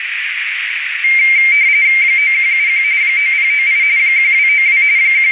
RTTY (45.45 baud, 170 Hz shift), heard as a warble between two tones, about 2200 Hz centre, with radio static and a narrow filter. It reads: 9171 9098 1292 …